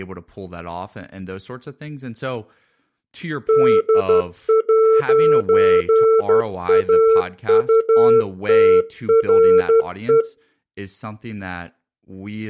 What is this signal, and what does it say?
Morse code, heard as a keyed tone, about 12 wpm, 450 Hz, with speech in English. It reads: D'AUTRE